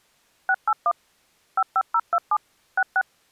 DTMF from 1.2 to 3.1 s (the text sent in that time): 55027 66